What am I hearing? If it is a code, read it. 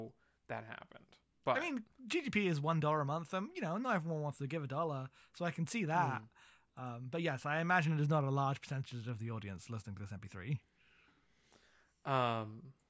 Speech in English. There is no code.